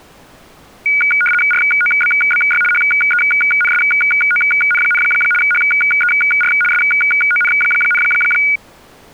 RTTY (75 baud, 850 Hz shift), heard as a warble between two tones, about 1850 Hz centre. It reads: ROBBY HENSON, HER SON,